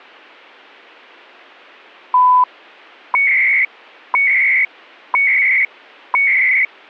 Radio time signal (CHU, Canada), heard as beeps and data bursts, one a second.